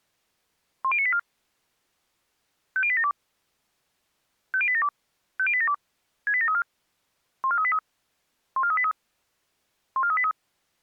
Five-tone selective call (ZVEI), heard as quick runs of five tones, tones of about 70 ms. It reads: 10984 50872 50872 50872 68734 14383 14383 14383